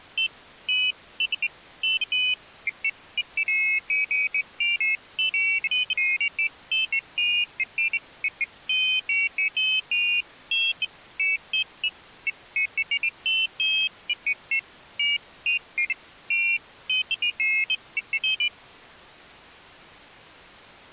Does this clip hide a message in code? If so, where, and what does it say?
No, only pairs of high tones at irregular times.